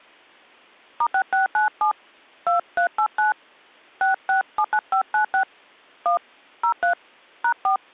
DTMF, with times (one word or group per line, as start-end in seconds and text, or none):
1.0-1.9 *6697
2.5-3.3 2389
4.0-5.4 6679596
6.1-6.2 1
6.6-6.9 03
7.4-7.8 #4